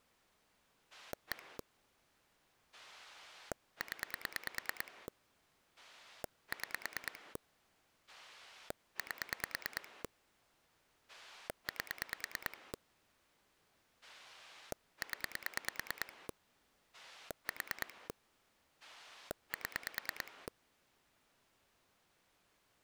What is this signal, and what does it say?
Pulse dialling, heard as a rotary dial, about 9 pulses a second. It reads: 1 0 6 8 8 0 4 7